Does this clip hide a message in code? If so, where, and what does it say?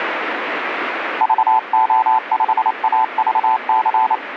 Yes: Morse code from 1.2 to 4.2 s, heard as a keyed tone, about 28 wpm, 880 Hz, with radio static. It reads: VO5AVC